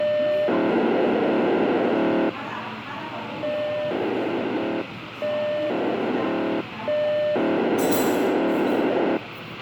POCSAG pager data (1200 baud), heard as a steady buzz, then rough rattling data, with radio hiss, a squelch burst at the end and the noise of a crowd indoors.